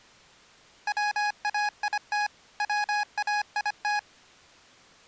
Morse code, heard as electronic beeps, machine-sent, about 25 wpm, 830 Hz. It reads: WAIT WAIT